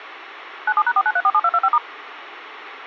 DTMF, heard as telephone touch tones, dialled by machine, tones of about 50 ms, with phone line noise. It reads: 97#49347225*